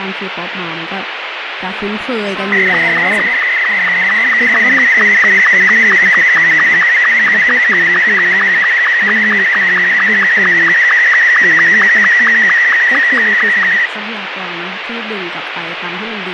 SSTV (slow-scan television), Martin M2, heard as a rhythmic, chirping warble, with radio static and speech in Thai.